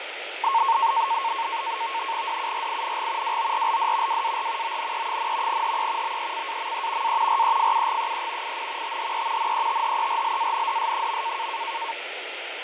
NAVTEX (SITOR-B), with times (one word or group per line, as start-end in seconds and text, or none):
2.3-3.4 DURING
3.2-4.2 WORLD
4.1-4.8 WAR
4.6-5.6 ONE,
5.5-6.2 HE
6.0-7.2 BECAME
7.0-7.4 A
7.3-8.6 REFUGEE
8.4-9.0 IN
8.8-9.5 THE
9.4-11.5 NETHERLANDS.